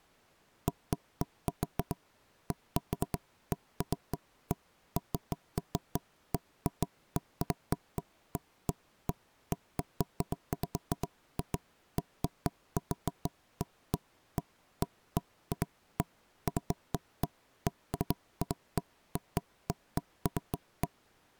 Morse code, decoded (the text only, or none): none